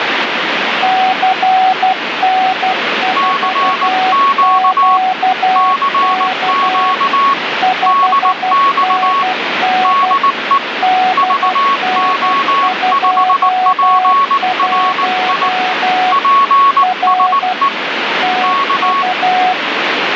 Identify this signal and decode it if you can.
Morse code, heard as two keyed tones, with radio static. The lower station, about 12 wpm, 740 Hz: CN4QK 5NN DN21 R TU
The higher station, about 19 wpm, 1110 Hz: CQ CQ DX DE VO5PRI PSE K